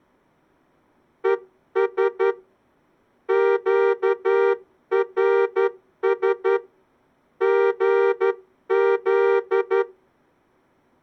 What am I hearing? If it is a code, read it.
Morse code, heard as a horn, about 11 wpm. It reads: ES QRS GZ